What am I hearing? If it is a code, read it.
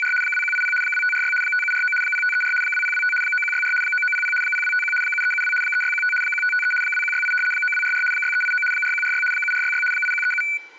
RTTY (75 baud, 850 Hz shift), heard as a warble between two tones, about 1900 Hz centre. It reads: … 2180 2546 5749 0534 2025 9164 9900 0251 7372 3615 1553 2168 9244 6389 4146 7466 8137